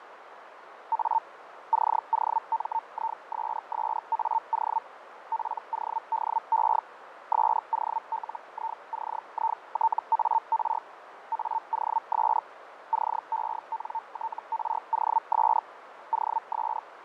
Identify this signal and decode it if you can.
Hellschreiber (Feld-Hell, 122.5 baud), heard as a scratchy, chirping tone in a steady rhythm, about 900 Hz, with radio static, fading and a narrow filter. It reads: A COMISSAO PODE SOLICITAR AOS CENTROS OS